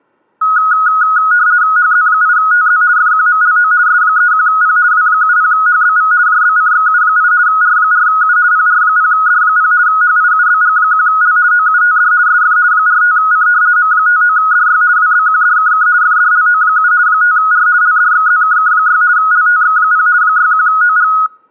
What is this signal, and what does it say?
RTTY (50 baud, 170 Hz shift), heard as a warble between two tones, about 1360 Hz centre. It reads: HZ8TZ FQMLO S31P W70HBV JBCXU8 R4U PR0D0 HIUBG1L OUTD SF 45C M59DY WBQDKK FDLO7 5R LDXZKK6 LTX0 61OG